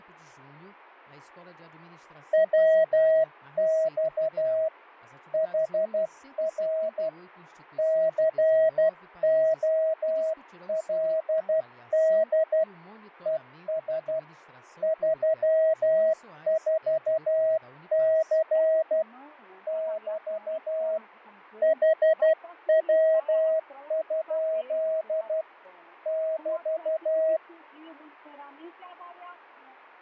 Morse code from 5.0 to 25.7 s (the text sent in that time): HR COLD ES 34C <BT> HW?